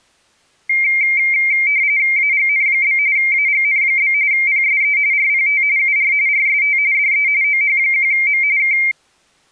RTTY (45.45 baud, 170 Hz shift), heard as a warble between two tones, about 2200 Hz centre. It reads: AGN? AGN? PSE RPT UR RST DE OH1M K